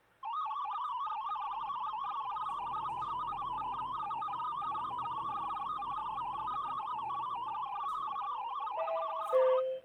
Multi-tone FSK (Olivia or MFSK type), about 500 Hz wide, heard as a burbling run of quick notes, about 62.5 baud, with the noise inside a lift.